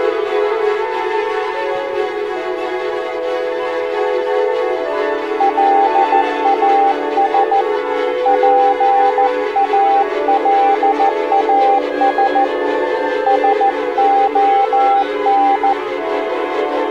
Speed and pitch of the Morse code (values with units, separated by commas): 14 wpm, 790 Hz